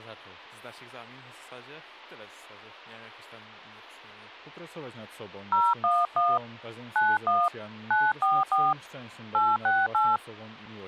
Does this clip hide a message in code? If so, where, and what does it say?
Yes: DTMF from 5.5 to 10.2 s, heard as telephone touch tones, dialled by hand, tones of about 210 ms. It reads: 011 91 944 868